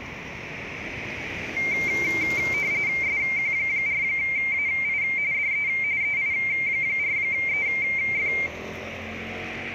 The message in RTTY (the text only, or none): SQ4AI DE EI4EF